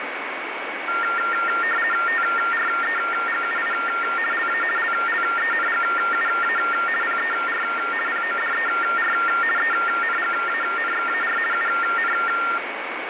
RTTY (50 baud, 450 Hz shift), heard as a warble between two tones, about 1600 Hz centre, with radio static and a steady whistle near 2240 Hz. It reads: TREGUI LA LLENGUA PER PODER ENGANXAR UN